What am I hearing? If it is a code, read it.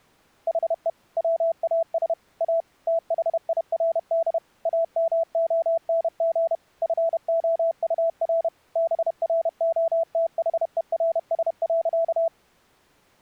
Morse code, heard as a keyed tone, machine-sent, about 31 wpm, 660 Hz. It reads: HE WAS A THIRD AMONG FOUR BROTHERS.